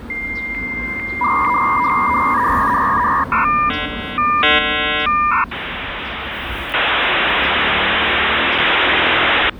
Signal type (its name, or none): dial-up modem handshake